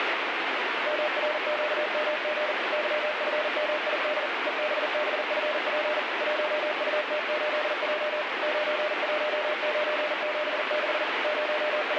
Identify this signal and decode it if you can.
Morse code, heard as a keyed tone, machine-sent, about 40 wpm, 600 Hz, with heavy radio static. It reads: MRQMG YFMID EBBFP 1UT8J 91976 …